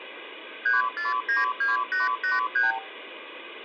Multi-frequency trunk signalling (R2, with the far end's replies), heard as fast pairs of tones, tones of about 160 ms, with phone line noise and room echo. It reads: 3492883